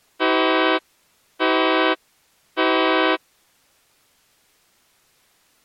Train horn signal, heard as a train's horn. 3 short. On North American railways: when stopped, the train will back up.